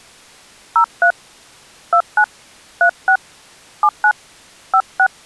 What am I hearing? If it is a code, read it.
DTMF, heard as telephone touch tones, dialled by hand, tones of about 70 ms. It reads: 03 29 36 79 56